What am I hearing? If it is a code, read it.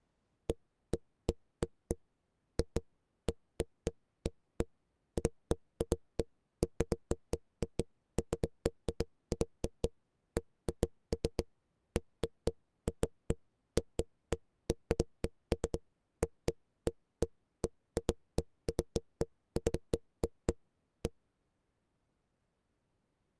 Irregular knocks on a wall. There is no code.